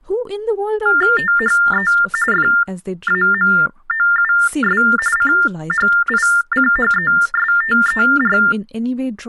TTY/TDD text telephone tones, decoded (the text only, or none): THE FAMOUS CHICHESTER